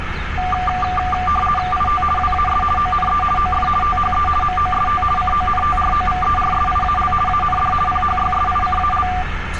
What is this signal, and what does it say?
RTTY (50 baud, 450 Hz shift), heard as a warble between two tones, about 960 Hz centre, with radio static and street noise. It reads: IT WAS ONE OF THE MOST CONTROVERSIAL AND PHYSICAL